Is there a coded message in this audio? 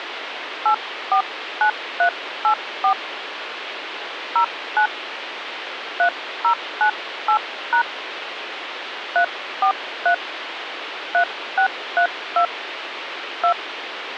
Yes: DTMF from 0.7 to 13.5 s, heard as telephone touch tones, dialled by hand, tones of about 90 ms, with phone line noise. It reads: 849384 09 3098# 343 3632 2